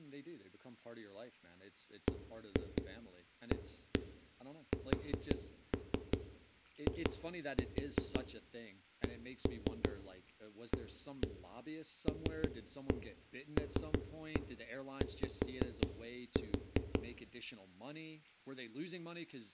Tap code, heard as knocks on a wall, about 5 knocks a second, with room echo and speech in English. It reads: BASICALLY